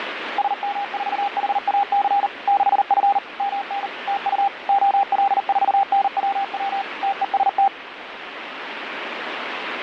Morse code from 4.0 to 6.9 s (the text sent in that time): TU OL4NWW